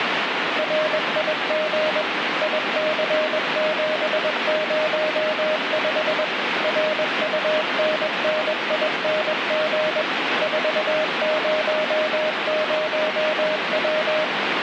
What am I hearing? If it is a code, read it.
Morse code, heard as a keyed tone, machine-sent, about 21 wpm, 620 Hz, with radio static. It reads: RIG IC705 RUNNING 400W